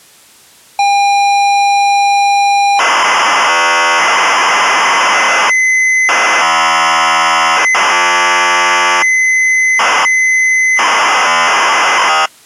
ZX Spectrum tape loading, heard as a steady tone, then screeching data.